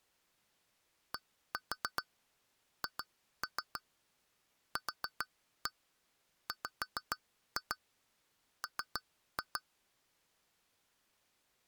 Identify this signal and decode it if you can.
Tap code, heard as taps on glass, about 6 knocks a second. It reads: DHQWM